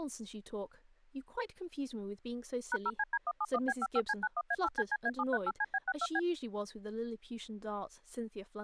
DTMF, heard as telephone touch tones, dialled by machine, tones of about 50 ms, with speech in English. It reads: #0CD171B55C91A8CCA738CB62B